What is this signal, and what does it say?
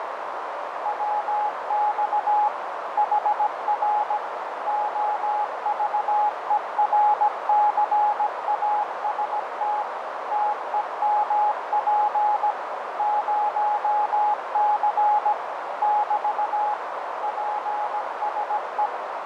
Morse code, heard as a keyed tone, machine-sent, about 17 wpm, 840 Hz, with heavy radio static, fading and a narrow filter. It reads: WX HR OVERCAST TEMP 0C <BT> PSE